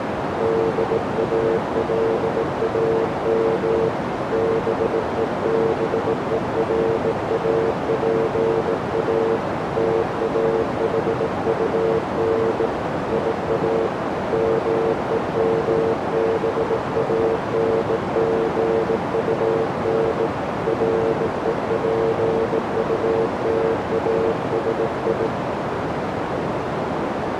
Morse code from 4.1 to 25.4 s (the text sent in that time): BEBERAPA TAHUN IA MEMBANGUN REPUTASI